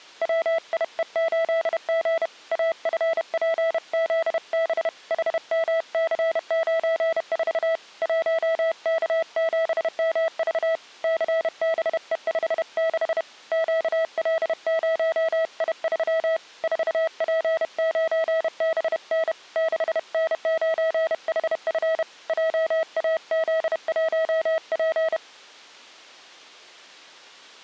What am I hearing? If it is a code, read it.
Morse code, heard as a keyed tone, hand-sent with a paddle, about 31 wpm, 650 Hz. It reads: WIE8G AFPZB HMC94 1K7MV CBE56 QL0I3 4P9BN 6N9HF JAZ1P